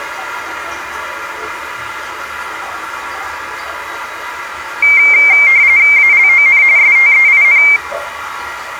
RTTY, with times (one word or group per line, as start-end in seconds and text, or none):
6.0-6.6 ALON
6.8-7.6 STEIN